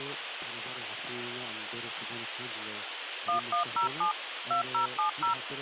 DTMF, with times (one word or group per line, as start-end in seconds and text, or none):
3.3-4.1 1107
4.5-5.3 2070